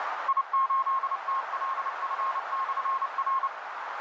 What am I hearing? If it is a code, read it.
Morse code, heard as a keyed tone, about 29 wpm, 1070 Hz, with radio static and a narrow filter. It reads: I8TLF/R